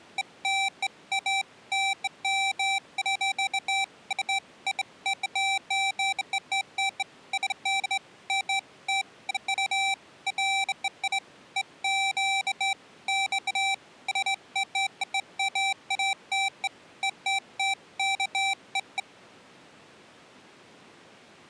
Beeps of irregular length. There is no code.